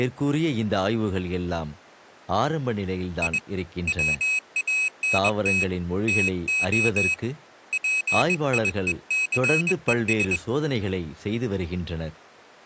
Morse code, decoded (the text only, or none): I WANT TO PIECES